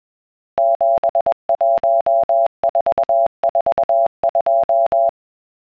Morse code, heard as a keyed tone, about 21 wpm, 680 Hz. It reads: 71442